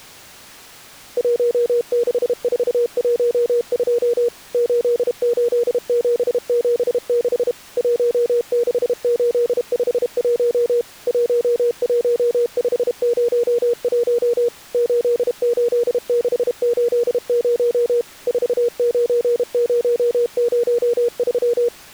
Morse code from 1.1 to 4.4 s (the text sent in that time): 16412